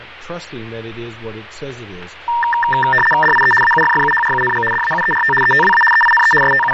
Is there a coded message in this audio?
Yes: RTTY (75 baud, 850 Hz shift) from 2.3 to 6.7 s, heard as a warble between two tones, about 1370 Hz centre, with radio static. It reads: DIE AUFFUHRUNG DAUERT ETWA EINE …